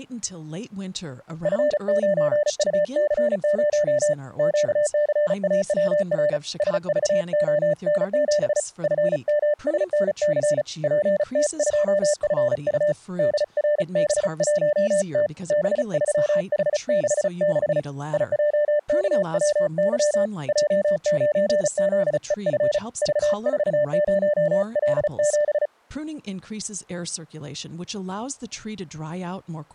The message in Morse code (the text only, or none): F9UC0 QCAWR SVON7 FMSNC PT2FU DRB1T B3H66 IJKWY J9ZEF V40L7